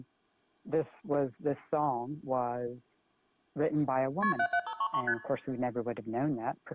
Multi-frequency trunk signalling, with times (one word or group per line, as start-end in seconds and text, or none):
4.2-4.3 KP
4.4-5.0 77533
5.1-5.1 ST